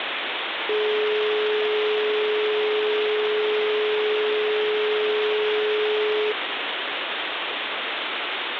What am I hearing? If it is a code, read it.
Telephone call progress tone (425 Hz plan, as in most of Europe), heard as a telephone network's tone, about 420 Hz, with phone line noise. Dial tone.